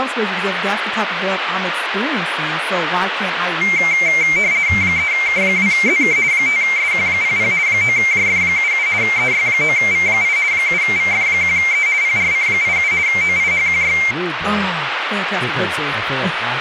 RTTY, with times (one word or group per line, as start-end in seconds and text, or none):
4.8-6.2 3K2ZK
6.3-7.5 5SQ00
7.7-8.9 9JF77
9.0-10.4 EY9V8
10.5-11.9 7VF1E
12.0-12.9 PRC87
13.1-14.0 OIHQY